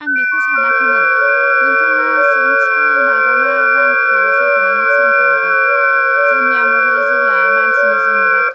FT8 (several signals at once), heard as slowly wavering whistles, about 6.25 baud, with speech in Bodo.